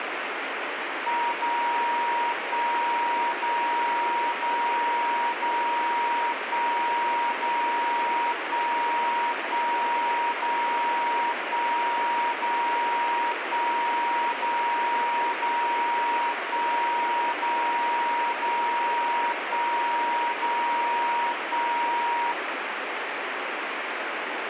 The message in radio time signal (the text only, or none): 0 1 0 0 0 1 0 1 1 0 1 0 1 0 0 1 0 0 1 0 1